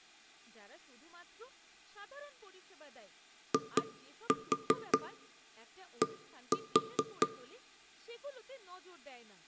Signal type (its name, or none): tap code